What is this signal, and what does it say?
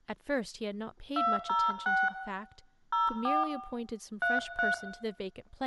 DTMF, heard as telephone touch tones, dialled by hand, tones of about 200 ms, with room echo and speech in English. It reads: 206 04 33